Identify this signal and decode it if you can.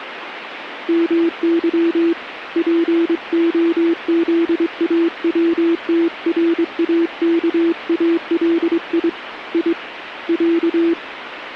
Morse code (Russian alphabet), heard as a keyed tone, hand-sent with a straight key, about 23 wpm, 340 Hz, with radio static. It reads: МЫ ПОЗАВТРАКАЛИ И Я